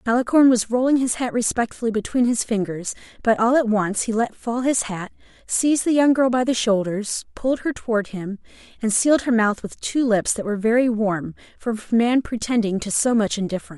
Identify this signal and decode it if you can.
Speech in English. There is no code.